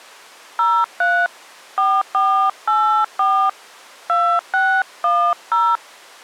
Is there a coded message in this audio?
Yes: DTMF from 0.6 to 5.8 s, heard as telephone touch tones, dialled by hand, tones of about 290 ms. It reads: 03 4484 2610